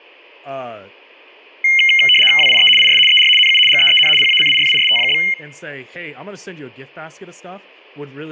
RTTY (75 baud, 850 Hz shift), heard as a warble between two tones, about 2550 Hz centre, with speech in English. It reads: WIE IS ER NU GEEN PACIFIST?